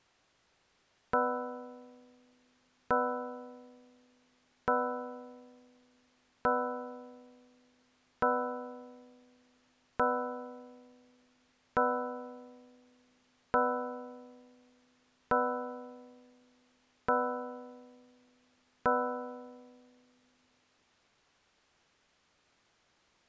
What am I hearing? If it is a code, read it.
Clock strike, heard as a bell. 11. Eleven o'clock.